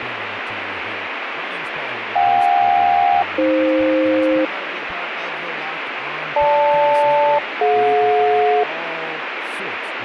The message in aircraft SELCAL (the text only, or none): JK-AF GL-DJ